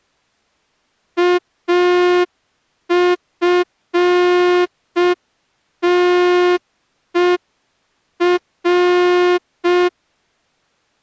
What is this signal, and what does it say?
Morse code, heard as a horn, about 5 wpm. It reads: AFTER